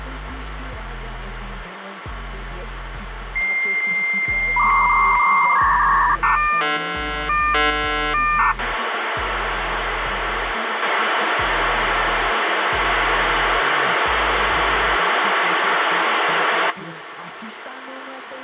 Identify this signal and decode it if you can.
Dial-up modem handshake (V.34 or later), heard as a whistle, warbles, then hiss, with phone line noise.